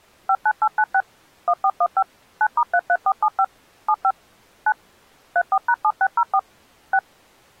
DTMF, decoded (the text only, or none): 59896 1415 9*33475 75 9 34#7604 6